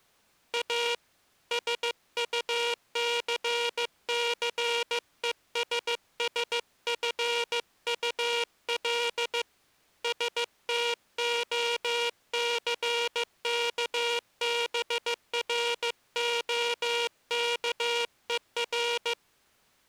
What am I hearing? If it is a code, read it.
Morse code, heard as a buzzer, hand-sent with a paddle, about 15 wpm. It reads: A SUCCESSFUL STOCKBROKER